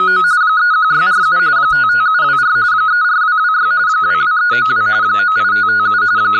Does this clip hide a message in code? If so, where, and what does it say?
Yes: RTTY (45.45 baud, 170 Hz shift) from 0.0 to 6.4 s, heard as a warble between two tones, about 1360 Hz centre, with speech in English. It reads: … 31647 55724 34226 22392 98557 …